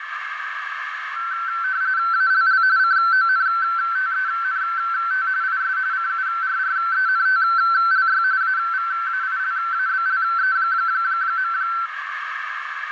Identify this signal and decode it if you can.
RTTY (45.45 baud, 170 Hz shift), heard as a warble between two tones, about 1440 Hz centre, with radio static, a narrow filter and room echo. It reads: ALL CONTENT IS CURRENTLY AVAILABLE.